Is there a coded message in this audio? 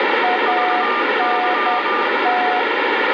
Yes: Morse code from 0.2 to 2.7 s, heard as two keyed tones, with radio static. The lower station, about 10 wpm, 730 Hz: ANT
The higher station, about 23 wpm, 1200 Hz: VY